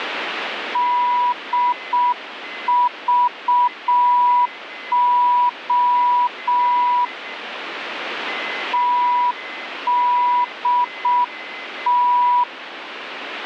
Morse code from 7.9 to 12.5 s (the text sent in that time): TDT